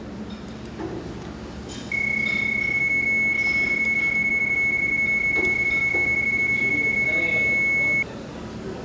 PSK31 (31.25 baud), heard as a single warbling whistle, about 2200 Hz, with the noise of a restaurant.